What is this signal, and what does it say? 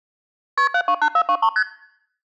Multi-frequency trunk signalling (R1, as on North American trunks), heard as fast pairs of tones, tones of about 70 ms. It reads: KP 728423 ST